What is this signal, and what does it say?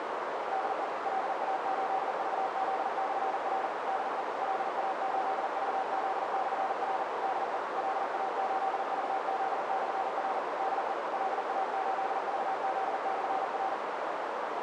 Morse code, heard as a keyed tone, machine-sent, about 40 wpm, 760 Hz, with heavy radio static and a narrow filter. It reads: DE LA8VZ/R DE LA8VZ/R DE LA8VZ/R DE LA8VZ/R